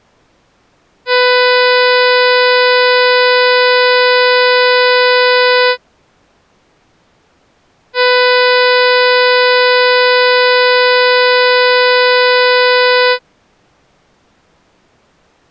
Ship horn signal, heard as a ship's horn, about 500 Hz. 2 long. At sea: a vessel under power that has stopped in fog.